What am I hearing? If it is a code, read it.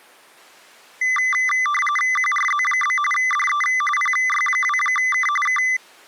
RTTY (45.45 baud, 850 Hz shift), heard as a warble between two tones, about 1600 Hz centre. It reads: QRZ? DE PY2K K